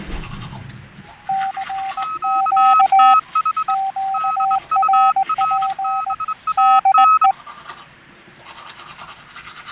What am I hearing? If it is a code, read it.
Morse code, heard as two keyed tones, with fading and the noise of a restroom. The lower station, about 19 wpm, 780 Hz: CQ QRP DE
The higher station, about 24 wpm, 1280 Hz: QTH DURBAN